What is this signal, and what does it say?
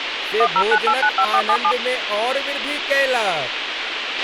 DTMF, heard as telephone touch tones, dialled by machine, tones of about 70 ms, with radio hiss, a squelch burst at the end and speech in Maithili. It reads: 109895477